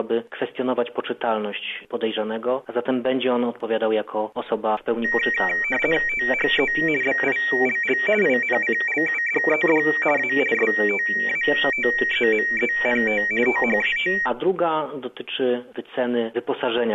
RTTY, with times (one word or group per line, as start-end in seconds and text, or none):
6.1-6.7 THE
7.0-8.0 BILL
8.2-9.8 INCLUDED
10.2-10.3 A
10.5-13.2 STATEMENT
13.5-14.1 THAT